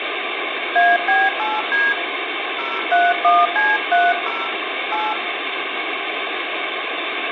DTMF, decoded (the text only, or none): AB8D 031C30 8